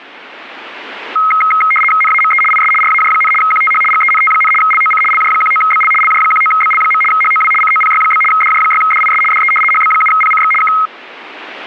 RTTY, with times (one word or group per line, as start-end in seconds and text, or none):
2.0-2.4 NAME
2.5-2.7 IS
2.8-3.3 RAJ,
3.4-3.8 QTH
3.9-4.5 GENT,
4.6-5.0 LOC
5.1-5.9 LJ19BL
6.0-7.0 LJ19BL.
7.1-7.5 HOW
7.6-8.2 COPY?
8.3-9.2 DJ6DIS
9.3-9.5 DE
9.7-10.5 HB7PCX
10.6-10.7 K